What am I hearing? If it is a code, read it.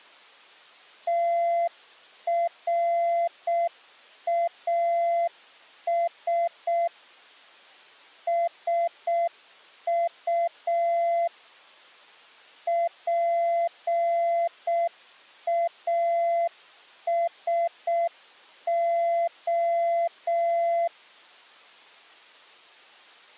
Morse code, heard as a keyed tone, machine-sent, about 6 wpm, 680 Hz. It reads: TRAS SU PASO